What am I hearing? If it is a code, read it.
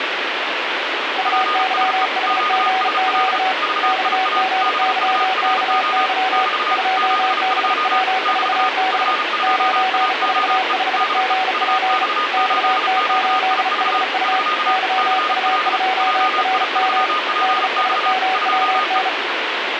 Morse code, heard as two keyed tones, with radio static. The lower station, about 35 wpm, 760 Hz: UYHGQ XGYKY 2BW4B 945GP XT8HU YU2RM DSMWN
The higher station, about 35 wpm, 1230 Hz: PSE QSL VIA BURO <BT> 72 <BT> F2AOE DE UX8QIV <SK> CL JI3PX 2E